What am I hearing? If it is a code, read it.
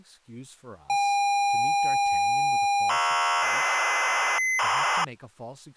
ZX Spectrum tape loading, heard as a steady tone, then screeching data, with speech in English.